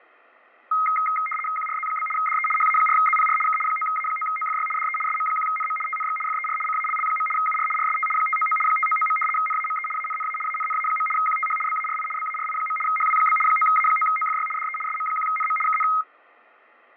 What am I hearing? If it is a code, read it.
RTTY (75 baud, 850 Hz shift), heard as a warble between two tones, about 1700 Hz centre, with fading. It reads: QRZ? DE HA4ZPR K 9A9OFY DE SM1NM TNX FER CALL. UR RST 599 599. NAME ANNA ANNA. QTH BARI BARI. HW? 9A9OFY DE SM1NM KN